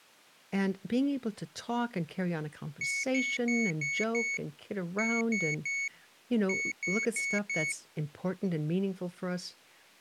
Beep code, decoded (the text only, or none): 5-3-4